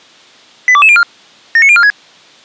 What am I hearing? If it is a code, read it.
Five-tone selective call (ZVEI), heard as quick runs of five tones, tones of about 70 ms. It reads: 82204 79046